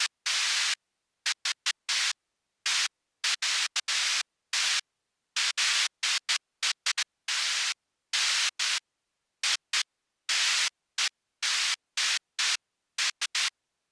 Bursts of noise. There is no code.